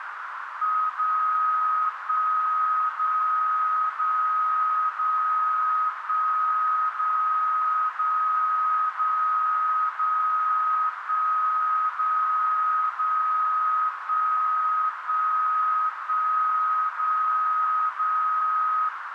Radio time signal (DCF77), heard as a tone whose level steps once a second, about 1260 Hz, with radio static and a narrow filter. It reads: 0 1 0 0 0 1 0 0 0 0 1 0 0 1 1 1 0 0